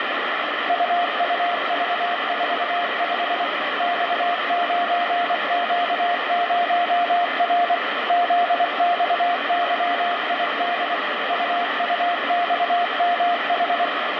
Morse code, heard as a keyed tone, machine-sent, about 24 wpm, 700 Hz, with heavy radio static. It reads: UUV45 X9Q0R ZXYID UUXMH